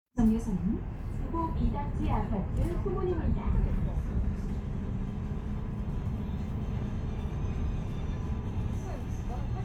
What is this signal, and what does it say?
The noise inside a bus. There is no code.